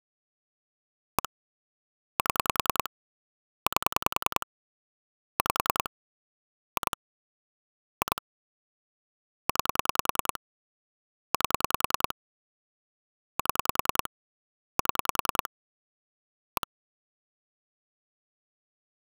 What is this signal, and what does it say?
Pulse dialling, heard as clicks on a phone line, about 10 pulses a second. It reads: 1 7 8 5 2 2 9 8 7 7 1